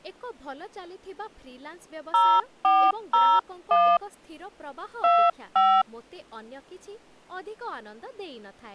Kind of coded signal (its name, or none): DTMF